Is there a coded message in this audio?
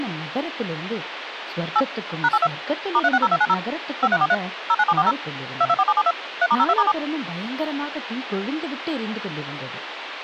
Yes: DTMF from 1.8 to 6.9 s, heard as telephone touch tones, dialled by machine, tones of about 50 ms, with phone line noise and speech in Tamil. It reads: 8 #82 *360290 5343 09740 224772 3*02*7